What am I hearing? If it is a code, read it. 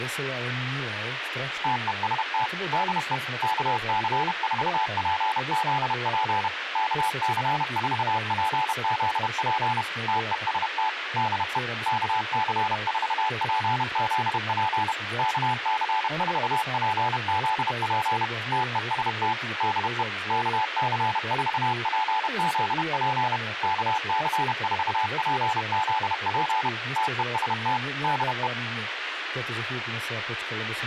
Morse code, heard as a keyed tone, machine-sent, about 31 wpm, 870 Hz, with radio hiss, a squelch burst at the end and speech in Slovak. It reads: TEST DE KC4PZP KC4PZP TEST DE KC4PZP KC4PZP TEST DE KC4PZP KC4PZP TEST DE